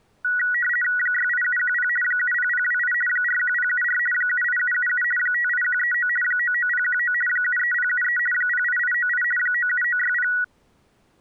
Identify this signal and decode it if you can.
RTTY (50 baud, 450 Hz shift), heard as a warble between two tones, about 1700 Hz centre. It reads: 68710 70028 41074 78777 58139 99019 73073 08898 97960